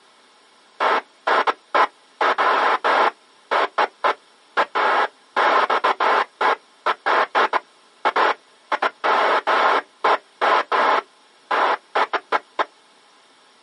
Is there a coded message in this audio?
No, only bursts of noise.